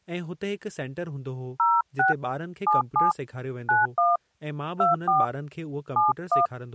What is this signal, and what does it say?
DTMF, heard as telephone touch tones, dialled by hand, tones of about 180 ms, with speech in Sindhi. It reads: 06 77 91 24 71